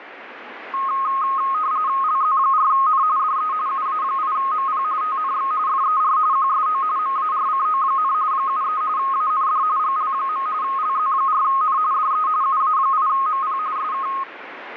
RTTY (45.45 baud, 170 Hz shift), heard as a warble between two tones, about 1170 Hz centre, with radio static. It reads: LZ4N DE UA8MP TNX FER QSO MARCO, 73 AND GL. LZ4N DE UA8MP SK